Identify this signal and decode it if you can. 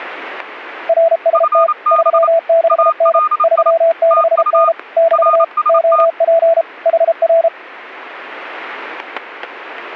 Morse code, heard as two keyed tones, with static crashes. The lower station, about 33 wpm, 660 Hz: RST 36N 36N <BT> OP HR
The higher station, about 28 wpm, 1230 Hz: FB ALI TU RST